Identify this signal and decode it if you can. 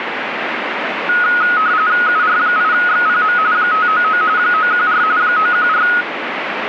RTTY (45.45 baud, 170 Hz shift), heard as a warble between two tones, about 1360 Hz centre, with radio static. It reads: UR8XPM 599 914 914